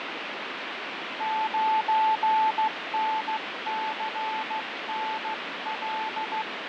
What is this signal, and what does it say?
Morse code, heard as a keyed tone, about 14 wpm, 880 Hz, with heavy radio static and fading. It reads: 9NCNL